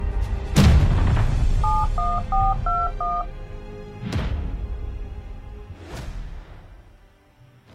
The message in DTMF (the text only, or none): 71421